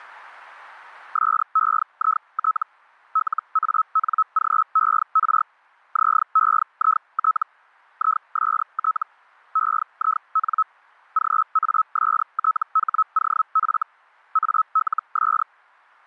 Hellschreiber (Feld-Hell, 122.5 baud), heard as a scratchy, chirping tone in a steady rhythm, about 1290 Hz. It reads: SEIT LANGER ZEIT IST EIN GASTHOF ALS